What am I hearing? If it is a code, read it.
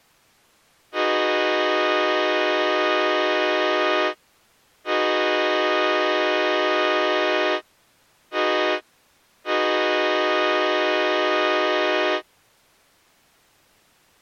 Train horn signal, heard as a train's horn. 2 long, 1 short, 1 long. On North American railways: approaching a public crossing.